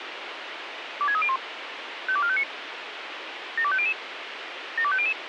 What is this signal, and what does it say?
Five-tone selective call (ZVEI), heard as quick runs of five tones, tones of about 70 ms, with radio hiss. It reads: 26301 52459 72500 72500